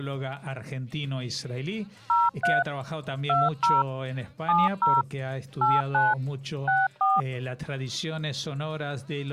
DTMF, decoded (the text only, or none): 03 20 70 89 64